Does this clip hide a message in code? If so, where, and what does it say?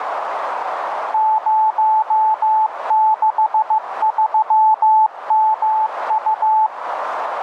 Yes: Morse code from 1.1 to 6.7 s, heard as a keyed tone, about 15 wpm, 870 Hz, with radio static and a narrow filter. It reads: 063MU